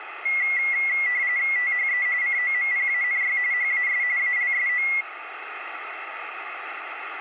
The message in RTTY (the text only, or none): THE COMPANY HAS ALSO